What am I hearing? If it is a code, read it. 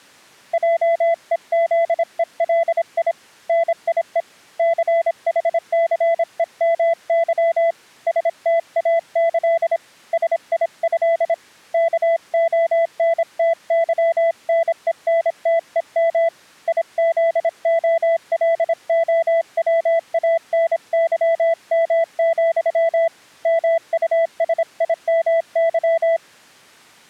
Morse code (with Polish letters), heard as a keyed tone, hand-sent with a paddle, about 26 wpm, 670 Hz. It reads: JEZELI NIE CHCEMY STAĆ SIĘ KONTYNENTEM IZOLOWANYM, MUSIMY